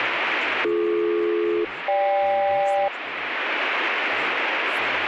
Aircraft SELCAL, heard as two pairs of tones, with radio static and speech in Hindi. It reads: BD-GK